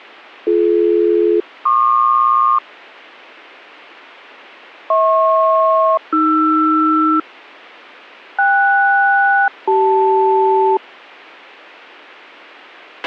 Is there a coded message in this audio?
Yes: aircraft SELCAL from 0.5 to 10.8 s, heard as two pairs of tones, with a squelch burst at the end. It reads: BD-PQ HP-AR KS-CL